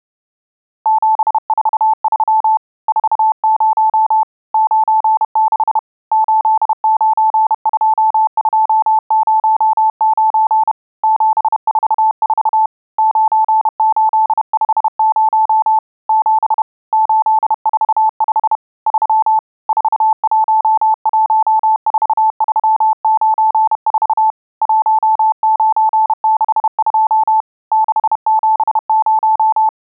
Morse code, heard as a keyed tone, hand-sent with a paddle, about 31 wpm, 870 Hz. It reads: 743 40 96 892209 744 9850 7 845 3 4114394 1962 670